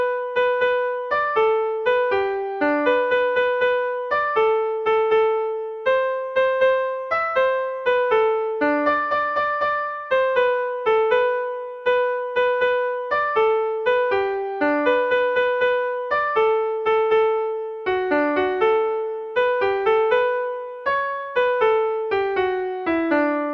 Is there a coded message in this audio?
No.